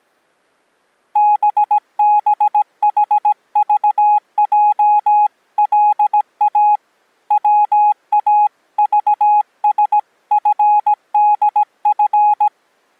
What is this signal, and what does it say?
Morse code (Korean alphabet), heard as a keyed tone, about 17 wpm, 840 Hz. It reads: 뚫고 보려는